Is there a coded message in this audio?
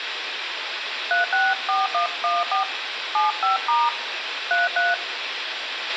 Yes: DTMF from 1.1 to 4.9 s, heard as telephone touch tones, dialled by hand, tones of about 150 ms, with radio hiss, a squelch burst at the end and room echo. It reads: 364114 75* 33